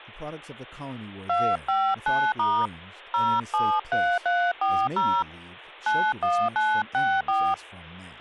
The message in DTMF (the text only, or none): 259* 073340 91964